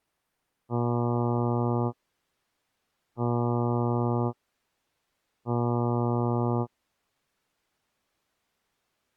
Ship horn signal, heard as a ship's horn, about 120 Hz. 3 short. At sea: I am operating astern propulsion.